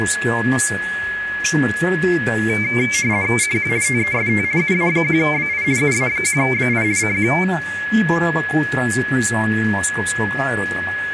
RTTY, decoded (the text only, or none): CQ TEST UA1BI UA1BI CQ